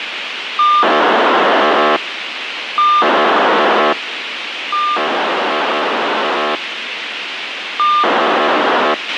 POCSAG pager data (2400 baud), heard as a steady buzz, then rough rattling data, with radio hiss and a squelch burst at the end.